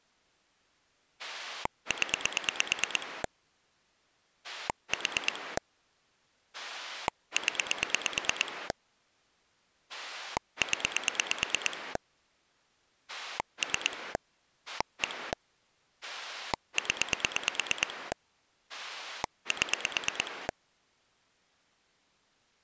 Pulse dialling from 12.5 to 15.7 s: 3 1

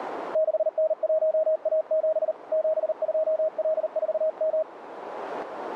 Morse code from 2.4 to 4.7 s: 72L4M

